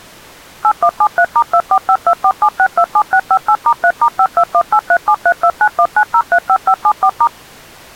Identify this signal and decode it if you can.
DTMF, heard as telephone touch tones, dialled by machine, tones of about 70 ms. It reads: 8173*245247627658*3*52183732919035574*